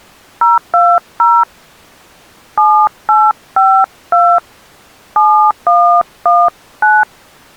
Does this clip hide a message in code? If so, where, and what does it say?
Yes: DTMF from 0.4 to 7.0 s, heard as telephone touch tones, dialled by hand, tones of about 260 ms. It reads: 020 7852 7119